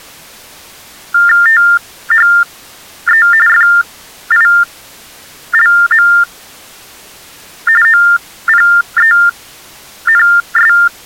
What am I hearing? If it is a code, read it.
TTY/TDD text telephone tones (45.45 baud Baudot), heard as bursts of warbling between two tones, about 400 Hz shift, 1600 Hz centre. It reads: THE FILM OPENS